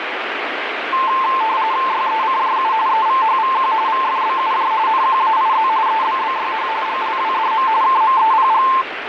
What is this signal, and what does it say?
RTTY (45.45 baud, 170 Hz shift), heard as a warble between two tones, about 970 Hz centre, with radio static. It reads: YECJU EVHVQ VFBUJ NQAIZ EBBYH GLWDM KMEPG